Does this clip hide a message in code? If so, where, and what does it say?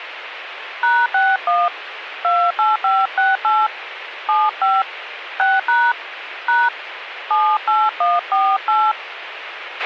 Yes: DTMF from 0.8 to 8.9 s, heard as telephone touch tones, dialled by hand, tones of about 220 ms, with radio hiss and a squelch burst at the end. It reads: #61 28568 75 6# # 78148